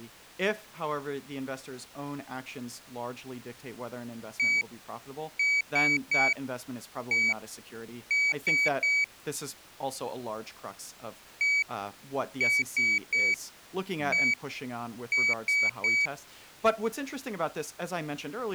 Beep code, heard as a piezo beeper, played twice, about 2300 Hz, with speech in English. 1-3-1-3. In Phoenix BIOS tables: keyboard controller test failure.